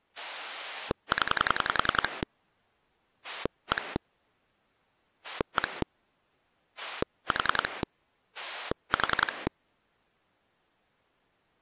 Pulse dialling, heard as a rotary dial, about 10 pulses a second. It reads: 0 1 1 4 4